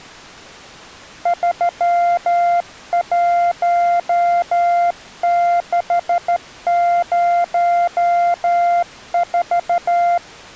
Morse code, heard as a keyed tone, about 13 wpm, 700 Hz. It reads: 31604